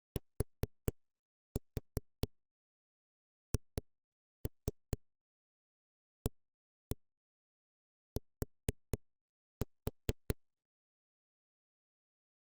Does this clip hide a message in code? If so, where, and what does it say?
Yes: tap code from 0.2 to 10.3 s, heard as knocks on a wall, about 4 knocks a second. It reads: THAT